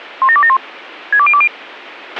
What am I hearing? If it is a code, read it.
Five-tone selective call (ZVEI), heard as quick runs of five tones, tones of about 70 ms, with a squelch burst at the end. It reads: 17271 62020